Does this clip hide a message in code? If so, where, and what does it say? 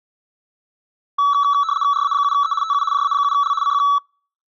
Yes: RTTY (75 baud, 170 Hz shift) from 1.2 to 4.0 s, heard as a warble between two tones, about 1220 Hz centre. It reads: RA7E TU JA7L CQ